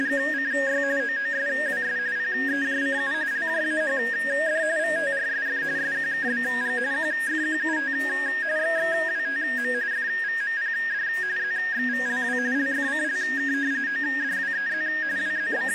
RTTY (45.45 baud, 170 Hz shift), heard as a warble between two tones, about 1750 Hz centre. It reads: … OOSWS PEJCU LJAHD VTRSF SQKBG QFQUT XXWTM FVMPD ZXVLW LFCLK ODWEZ …